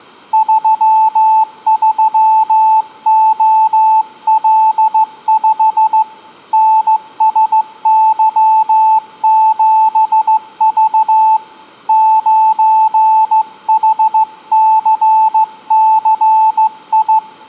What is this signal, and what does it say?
Morse code, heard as a keyed tone, hand-sent with a straight key, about 15 wpm, 880 Hz, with room echo. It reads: 33OL5 NSY7V 9HCCI